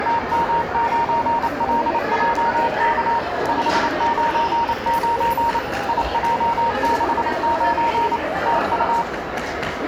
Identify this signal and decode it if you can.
Morse code, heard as a keyed tone, machine-sent, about 28 wpm, 930 Hz, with the noise of a crowd indoors. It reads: TM9LJK 599 IJ69 TU